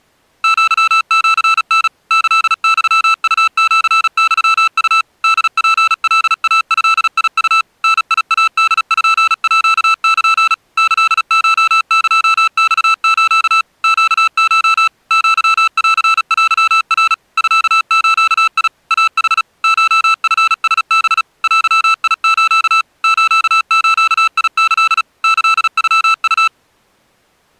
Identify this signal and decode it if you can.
Morse code (Japanese Wabun code), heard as electronic beeps, machine-sent, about 36 wpm, 1320 Hz. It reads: アシタ キユウシユウ ホツカイドウ ダイポール キコエマス ネコ アンテナ ミズ イヌ コチラハ デス スズキ キノウ